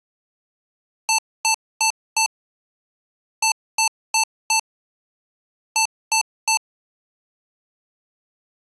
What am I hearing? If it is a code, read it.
Beep code, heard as beeps from a small speaker, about 880 Hz. 4-4-3. In Phoenix BIOS tables: maths coprocessor failure.